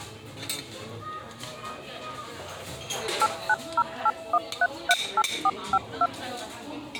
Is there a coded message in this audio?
Yes: DTMF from 3.2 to 6.1 s, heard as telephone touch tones, dialled by machine, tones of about 50 ms, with the noise of a restaurant. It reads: 89081338452